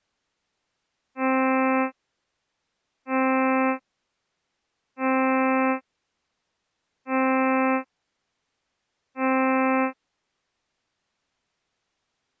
Ship horn signal, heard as a ship's horn, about 260 Hz. 5 short. At sea: I doubt that you are doing enough to avoid a collision.